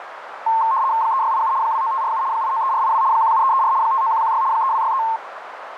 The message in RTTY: 3687 29547 893482 17334 59116 3263

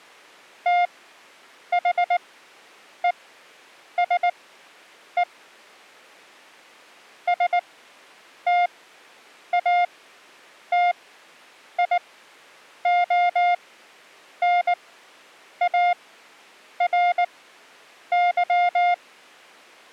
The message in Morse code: THESE STATIONARY

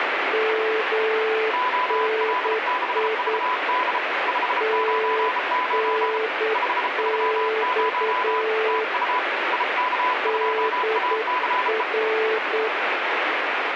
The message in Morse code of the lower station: MNI TNX DR

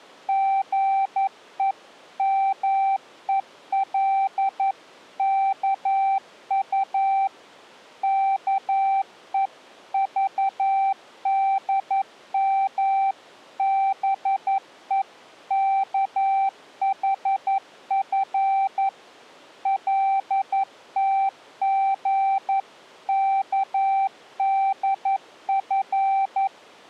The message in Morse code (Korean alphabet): 사막이 아름다운 것은

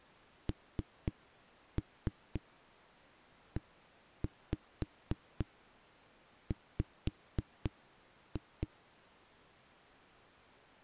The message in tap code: NEW

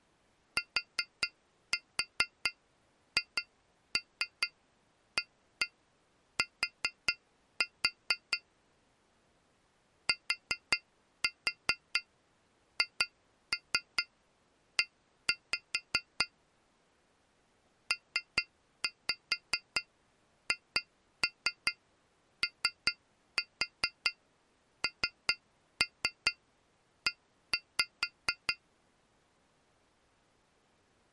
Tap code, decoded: THAT THE PHONE

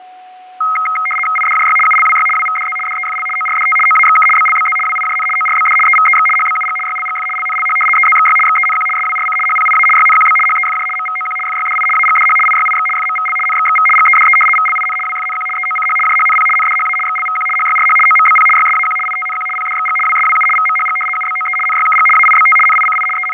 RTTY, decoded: IDJY ULWY WVDZ DEFL ORDT OAXK BLBZ WIJN ORBD EVEX HBUG YLGF LNLH EZXY XENQ SWRC HPIA YNQB HEFJ MVOQ FYDI AGDH IYIX FMVL NXXV GEDE VLIN WFNQ EOCH JHNP NDHA XLVQ HYRH OMBP YSAQ ITNQ PDXG WSWU VMHG UBOE NYKG AIBT NICI …

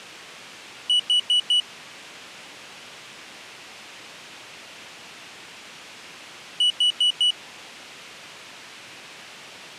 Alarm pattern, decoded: temporal four

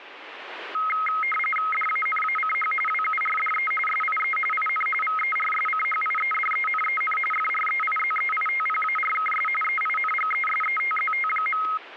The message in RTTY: DANACH WURDE SIE IN VERSCHIEDENEN FREIZEITPARKS EINGESETZT.

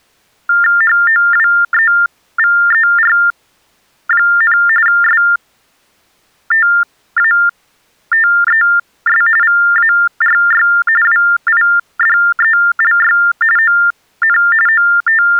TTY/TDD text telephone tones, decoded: HOWEVER, STATES VARY WIDELY ON …

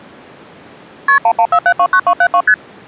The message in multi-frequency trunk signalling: KP 114729272 ST

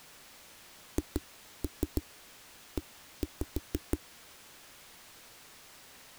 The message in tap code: HE

